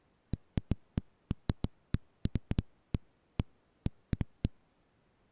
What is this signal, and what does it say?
Irregular knocks on a wall. There is no code.